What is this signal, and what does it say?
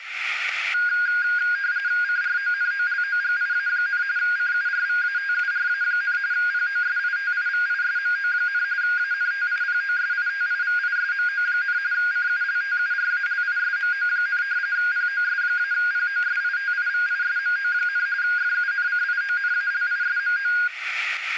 RTTY (45.45 baud, 170 Hz shift), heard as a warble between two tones, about 1550 Hz centre, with radio static, static crashes and room echo. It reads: CRONOLOGIA, CURVATURA, POSITIVISMO, ANTIPOSITIVISMO, CULTURALISMO, POS-POSITIVISMO, FUNCIONALISMO